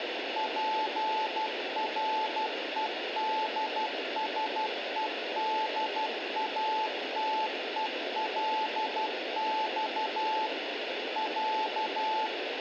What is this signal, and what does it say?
Morse code (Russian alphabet), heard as a keyed tone, machine-sent, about 12 wpm, 870 Hz, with radio static. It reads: ПРЕДСЕДАТЕЛЬ Я